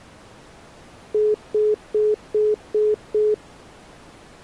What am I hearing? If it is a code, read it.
Telephone call progress tone (single-tone plan, as in most of Europe), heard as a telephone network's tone, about 420 Hz, 0.2 s on and 0.2 s off. Congestion tone.